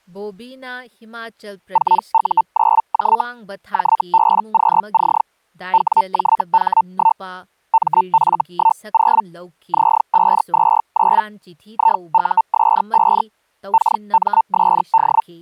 Hellschreiber (Feld-Hell, 122.5 baud), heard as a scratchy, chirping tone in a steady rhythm, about 900 Hz, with speech in Manipuri. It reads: 4U9J JBQC WJH1 MF10 Z529 IUS5 KMSD